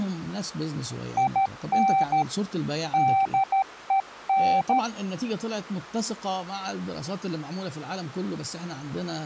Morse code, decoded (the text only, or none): IN DEN